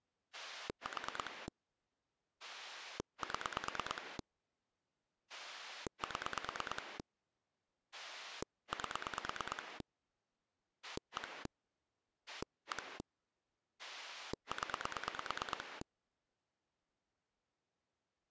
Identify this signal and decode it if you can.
Pulse dialling, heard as a rotary dial, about 9 pulses a second. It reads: 4 7 7 8 1 1 0